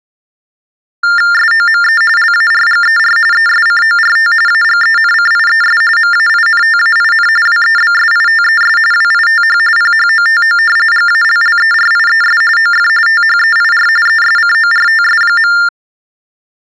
TTY/TDD text telephone tones (45.45 baud Baudot), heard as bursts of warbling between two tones, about 400 Hz shift, 1600 Hz centre. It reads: SOME LARGER ESCORT AGENCIES MAINTAIN WEBSITES WITH PHOTO GALLERIES OF THEIR ESCORTS.